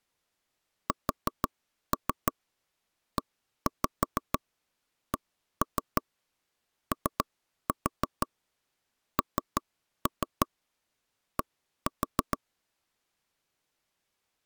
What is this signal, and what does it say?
Tap code, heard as knocks on wood, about 6 knocks a second. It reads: SECOND